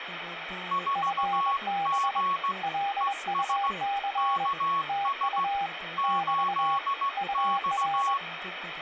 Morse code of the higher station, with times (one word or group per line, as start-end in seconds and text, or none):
0.7-2.5 4G
3.0-3.7 ES
4.2-5.4 KS
6.0-8.2 8X